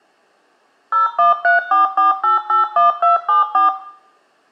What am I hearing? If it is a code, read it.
DTMF, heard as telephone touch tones, dialled by machine, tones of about 140 ms, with room echo. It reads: 01344881274